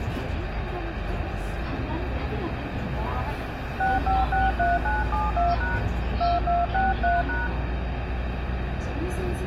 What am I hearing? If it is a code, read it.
DTMF, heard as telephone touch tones, dialled by hand, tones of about 180 ms, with radio hiss, room echo and the noise inside a bus. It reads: 6563972# 2263#